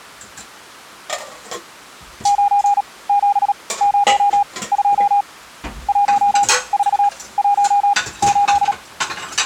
Morse code, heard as a keyed tone, machine-sent, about 37 wpm, spaced as for 21 wpm, 810 Hz, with kitchen noise. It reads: 9702 1418